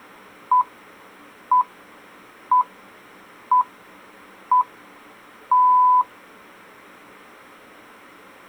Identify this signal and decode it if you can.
Radio time signal (six pips, as the Greenwich Time Signal), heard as pips.